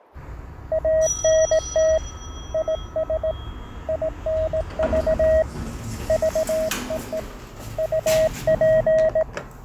Morse code, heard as a keyed tone, hand-sent with a straight key, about 18 wpm, 640 Hz, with fading and the noise inside a lift. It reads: ANT IS INV VEE UP